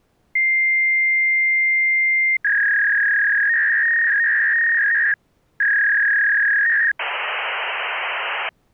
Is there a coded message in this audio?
Yes: fax machine handshake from 0.4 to 8.5 s, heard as a long tone, a warble and hiss.